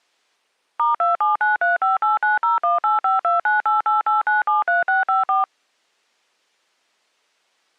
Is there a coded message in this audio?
Yes: DTMF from 0.8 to 5.4 s, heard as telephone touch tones, dialled by machine, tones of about 150 ms. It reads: *2793589018529888973654